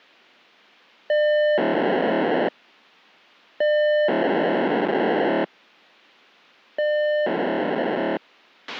POCSAG pager data (1200 baud), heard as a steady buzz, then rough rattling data, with a squelch burst at the end.